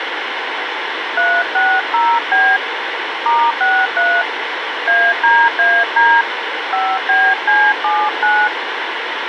DTMF, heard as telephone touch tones, dialled by hand, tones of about 250 ms, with radio hiss. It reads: 360B *63 ADAD 5BC79